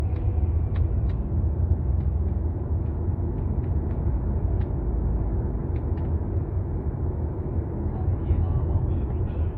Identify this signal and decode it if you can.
The noise inside a car. There is no code.